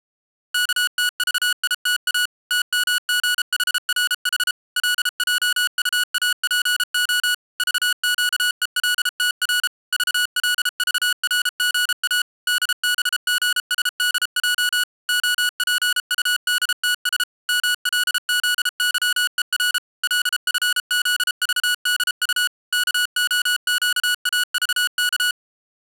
Morse code, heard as electronic beeps, machine-sent, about 33 wpm, 1460 Hz. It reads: KTVITA TMGHRH LJUAPO VQELTR VLVRGA DBGSDJ OPUDTS MLZYER LFZVDU KOQAVK